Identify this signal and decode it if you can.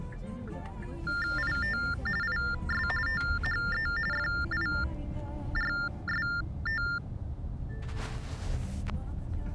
TTY/TDD text telephone tones (45.45 baud Baudot), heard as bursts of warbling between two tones, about 400 Hz shift, 1600 Hz centre, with the noise inside a car. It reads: IT IS THE FIRST